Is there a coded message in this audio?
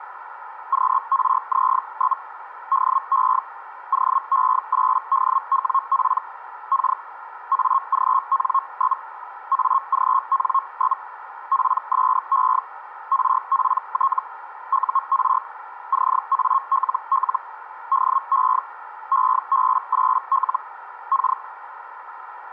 Yes: Hellschreiber (Feld-Hell, 122.5 baud) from 0.7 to 21.4 s, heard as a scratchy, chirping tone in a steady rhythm, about 1080 Hz, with radio static. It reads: QRZ? DE OE8DWP K AGN? AGN? PSE RPT UR CALL DE EB8L K